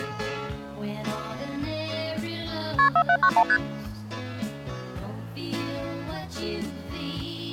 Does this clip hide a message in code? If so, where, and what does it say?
Yes: multi-frequency trunk signalling (R1, as on North American trunks) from 2.8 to 3.6 s, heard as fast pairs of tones, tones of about 70 ms. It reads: KP 4791 ST